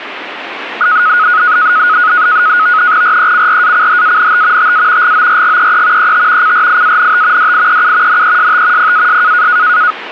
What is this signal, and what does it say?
NAVTEX (SITOR-B), 100 baud, 170 Hz shift, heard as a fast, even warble, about 1360 Hz centre, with radio static. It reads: RECRACHANT TA GORGEE ET CRIANT DIEU NEST PAS